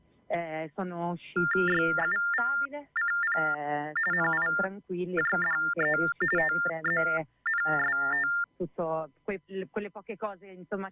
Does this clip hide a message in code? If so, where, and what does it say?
Yes: TTY/TDD text telephone tones (45.45 baud Baudot) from 1.4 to 8.4 s, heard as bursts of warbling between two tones, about 400 Hz shift, 1600 Hz centre. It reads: YUVCP NIJDE TZNST